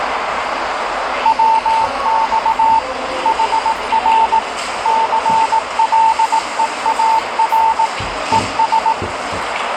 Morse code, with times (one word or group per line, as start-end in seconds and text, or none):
1.3-2.8 WX
3.3-4.4 HR
4.9-7.9 CLEAR
8.3-8.9 ES